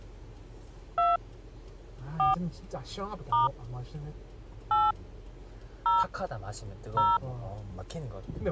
DTMF, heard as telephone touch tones, dialled by hand, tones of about 170 ms, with the noise inside a car. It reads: 2 4 * 8 0 0